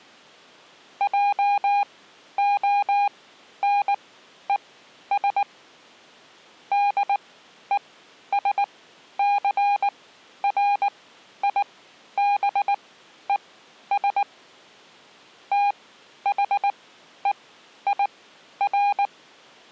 Morse code, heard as a keyed tone, machine-sent, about 19 wpm, spaced as for 11 wpm, 810 Hz. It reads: JONES DESCRIBES THEIR